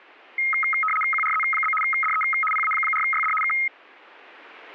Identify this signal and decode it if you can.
RTTY (75 baud, 850 Hz shift), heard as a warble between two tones, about 1700 Hz centre. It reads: QRZ? DE PA4YD K